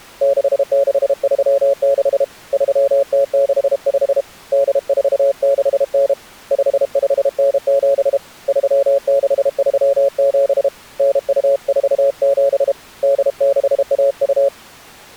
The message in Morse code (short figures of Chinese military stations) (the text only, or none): 6636 3065 8469 5597 3637 9247 8612